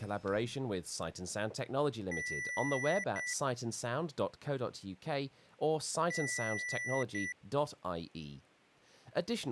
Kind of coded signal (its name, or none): beep code